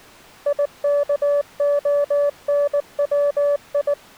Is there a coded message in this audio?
Yes: Morse code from 0.4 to 4.0 s, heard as a keyed tone, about 19 wpm, 580 Hz. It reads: IKONWI